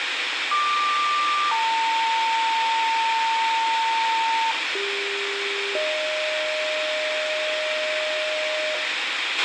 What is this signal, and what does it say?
Two-tone page, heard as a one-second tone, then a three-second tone, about 1180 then 900 Hz, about 400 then 620 Hz, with radio hiss, a squelch burst at the end and room echo.